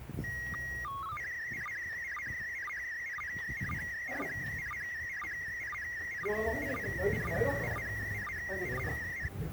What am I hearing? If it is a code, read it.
SSTV (slow-scan television), PD 120, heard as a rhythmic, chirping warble, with radio static and the noise of a residential street.